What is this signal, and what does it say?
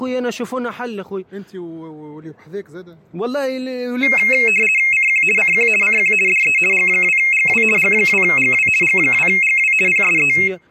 RTTY (50 baud, 450 Hz shift), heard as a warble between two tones, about 2350 Hz centre. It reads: CQ CQ CQ DE G2GW G2GW G2GW PSE